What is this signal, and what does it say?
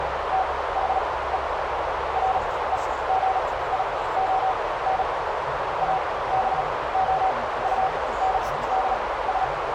Morse code, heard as a keyed tone, machine-sent, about 37 wpm, spaced as for 19 wpm, 760 Hz, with heavy radio static, a narrow filter and the noise inside a car. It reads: THE REGION ABOUNDS